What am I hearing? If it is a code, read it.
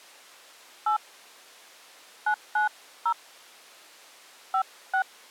DTMF, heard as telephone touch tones, dialled by hand, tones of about 100 ms. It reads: 8 990 56